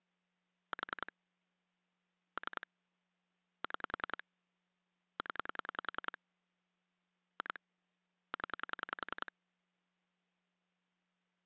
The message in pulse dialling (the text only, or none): 4 3 6 0 2 0